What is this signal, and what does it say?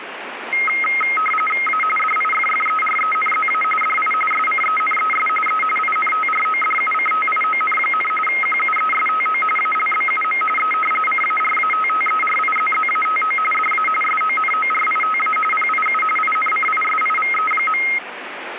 RTTY (45.45 baud, 850 Hz shift), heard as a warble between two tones, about 1700 Hz centre, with radio static. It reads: A DIFFERENZA DI SCENES E INTRODUCTION, QUESTO ALBUM E CARATTERIZZATO DA SONORITA PIU INCISIVE.